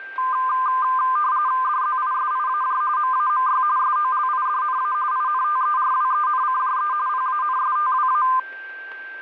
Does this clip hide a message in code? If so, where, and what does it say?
Yes: RTTY (45.45 baud, 170 Hz shift) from 0.2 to 8.4 s, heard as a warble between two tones, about 1120 Hz centre, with a steady whistle near 1570 Hz. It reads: DZISIAJ MAMY SOLIDNA INTERWENCJE PANSTWA